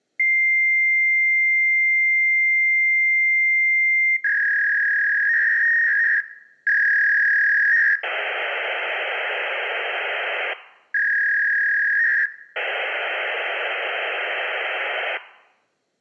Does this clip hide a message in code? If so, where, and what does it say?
Yes: fax machine handshake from 0.2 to 15.2 s, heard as a long tone, a warble and hiss.